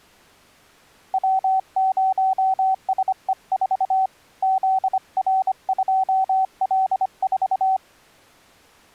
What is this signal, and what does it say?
Morse code, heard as a keyed tone, hand-sent with a paddle, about 25 wpm, 760 Hz. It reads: W0SE4 ZR2L4